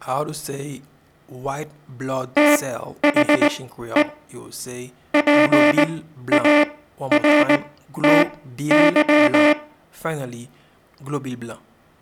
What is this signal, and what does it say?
Morse code, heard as a buzzer, machine-sent, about 19 wpm, spaced as for 12 wpm, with room echo. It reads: THE PARTY